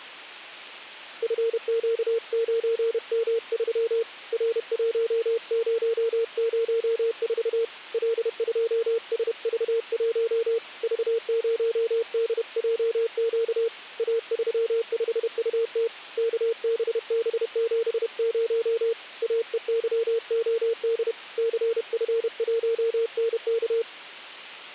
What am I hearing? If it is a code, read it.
Morse code, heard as a keyed tone, hand-sent with a paddle, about 31 wpm, 460 Hz. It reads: FQ9M3 R1004 L2SV1 V0DJQ A35UT KBB70 AEYOD CF1NK